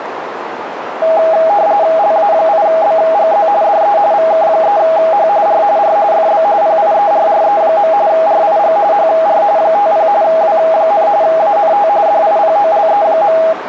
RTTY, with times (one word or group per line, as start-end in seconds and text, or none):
2.0-3.5 LA8BGZ
3.6-4.0 DE
4.1-5.3 VK3H
5.5-5.6 R
5.8-6.0 R
6.1-6.4 FB
6.6-7.9 PIERRE.
8.1-8.8 RIG
8.9-9.4 HR
9.6-10.1 50
10.2-11.1 W,
11.2-11.9 ANT
12.1-13.4 DIPOLE.